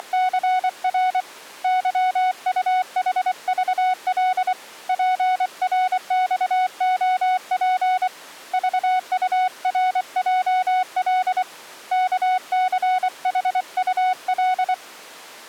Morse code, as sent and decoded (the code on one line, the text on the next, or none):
… / -.-- ..- .... ...- .-.. / .--. .-. -..- --- .--. / ...- ..- .-. .--- .-.. / -.- -.-. .... ..- .-..
… YUHVL PRXOP VURJL KCHUL